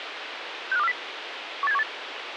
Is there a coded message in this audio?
Yes: five-tone selective call (EEA) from 0.7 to 1.8 s, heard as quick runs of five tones, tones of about 40 ms, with radio hiss. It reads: 65240 18718